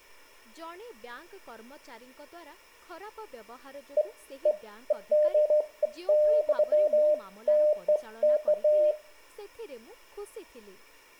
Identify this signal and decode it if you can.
Beeps of irregular length, with room echo and speech in Odia. There is no code.